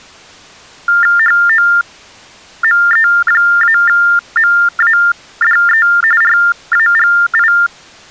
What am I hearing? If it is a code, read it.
TTY/TDD text telephone tones (45.45 baud Baudot), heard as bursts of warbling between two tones, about 400 Hz shift, 1600 Hz centre. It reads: HOME-MADE RAGI